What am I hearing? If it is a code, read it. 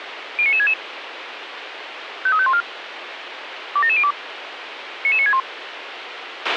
Five-tone selective call (ZVEI), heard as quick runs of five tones, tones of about 70 ms, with radio hiss and a squelch burst at the end. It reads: 09966 53514 27702 99961